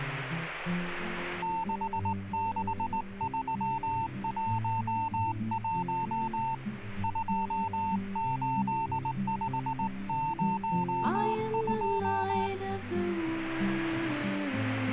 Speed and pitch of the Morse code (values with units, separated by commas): 19 wpm, 900 Hz